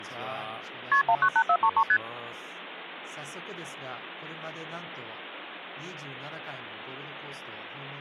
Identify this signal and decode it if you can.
Multi-frequency trunk signalling (R1, as on North American trunks), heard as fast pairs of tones, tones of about 70 ms, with speech in Japanese. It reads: KP 198433 ST